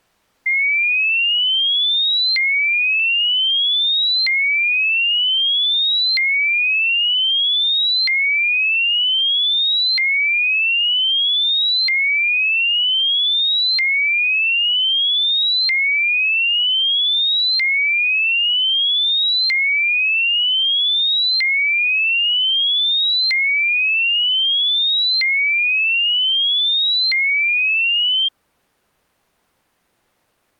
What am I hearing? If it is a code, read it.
A tone that sweeps in pitch again and again. There is no code.